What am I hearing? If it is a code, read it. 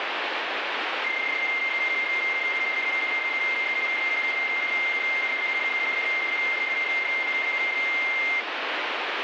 PSK31 (31.25 baud), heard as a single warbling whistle, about 2100 Hz, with radio static.